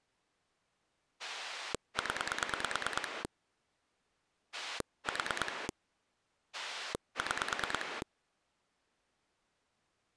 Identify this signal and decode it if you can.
Pulse dialling, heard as a rotary dial, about 9 pulses a second. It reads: 0 4 6